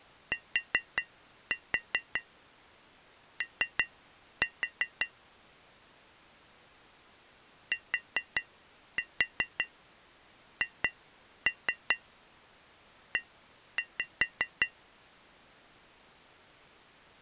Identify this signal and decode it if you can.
Tap code, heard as taps on glass, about 5 knocks a second. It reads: TO THE